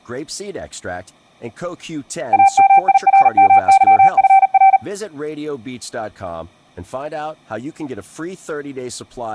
Morse code (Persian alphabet), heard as a keyed tone, machine-sent, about 39 wpm, 780 Hz, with speech in English. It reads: امیرمظفر